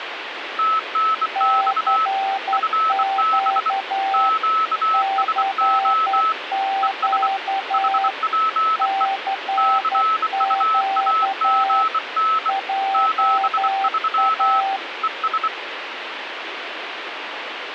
Morse code, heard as two keyed tones, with radio static. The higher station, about 24 wpm, 1300 Hz: TNX FB QSO ES HPE CUAGN 73 ES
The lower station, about 11 wpm, 780 Hz: CQ CQ CQ JA